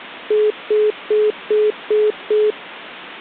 Telephone call progress tone (single-tone plan, as in most of Europe), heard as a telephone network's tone, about 420 Hz, 0.2 s on and 0.2 s off. Congestion tone.